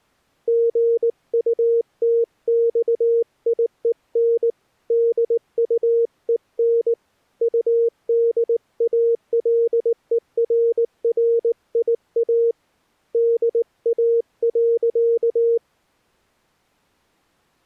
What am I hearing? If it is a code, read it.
Morse code, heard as a keyed tone, hand-sent with a paddle, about 19 wpm, 460 Hz. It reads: GUTXIEN DUEN UDALERRIA DA.